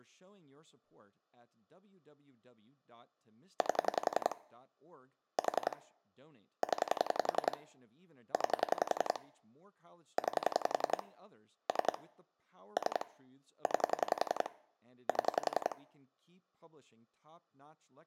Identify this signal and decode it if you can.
Pulse dialling, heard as clicks on a phone line, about 11 pulses a second, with speech in English. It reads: 8 4 0 9 9 3 3 9 7